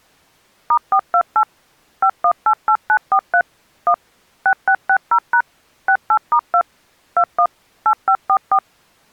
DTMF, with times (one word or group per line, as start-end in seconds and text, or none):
0.7-1.4 *428
2.0-3.4 5188943
3.9-3.9 1
4.5-5.4 6660#
5.9-6.6 68*2
7.2-7.5 21
7.9-8.6 8544